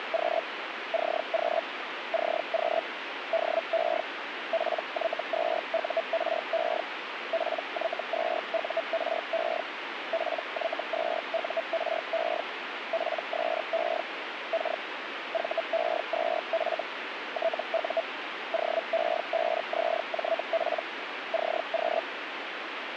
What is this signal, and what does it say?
Hellschreiber (Feld-Hell, 122.5 baud), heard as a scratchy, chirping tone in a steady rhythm, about 660 Hz, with radio static. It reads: … CQ CQ DE PY2URE PY2URE PY2URE PSE K VE2F TU OE5ZJP CQ